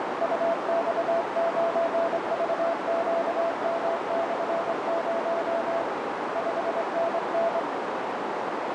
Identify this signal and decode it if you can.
Morse code, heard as a keyed tone, hand-sent with a straight key, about 24 wpm, 670 Hz, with heavy radio static and a narrow filter. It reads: UX9VQM/0 5NN